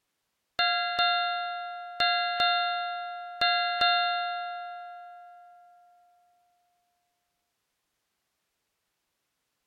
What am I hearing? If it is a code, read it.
Ship's bell, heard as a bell. 6. Six half-hours of the watch have passed.